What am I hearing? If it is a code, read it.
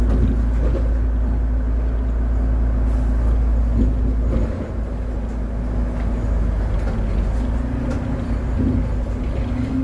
The noise inside a bus. There is no code.